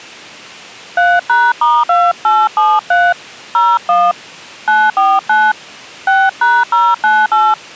DTMF, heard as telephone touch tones, dialled by hand, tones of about 220 ms. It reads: 3#*2873 01 949 6#098